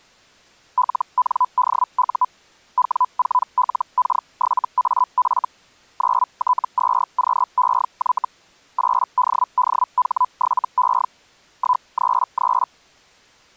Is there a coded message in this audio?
Yes: Hellschreiber (Feld-Hell, 122.5 baud) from 0.8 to 12.7 s, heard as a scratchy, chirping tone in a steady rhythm, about 1000 Hz. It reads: LNDU W4LK7AF 9T2QEY 8DDH7E 133